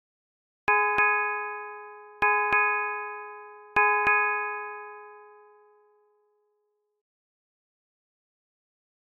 Ship's bell, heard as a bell. 6. Six half-hours of the watch have passed.